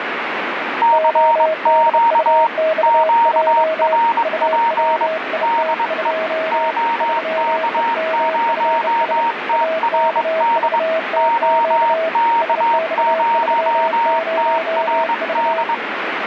Morse code, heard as two keyed tones, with radio static. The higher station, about 22 wpm, 930 Hz: CQ QRP DE OK0TRD OK0TRD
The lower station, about 30 wpm, 640 Hz: ODUXJ UWIT2 3EMFS AKVTQ SX30V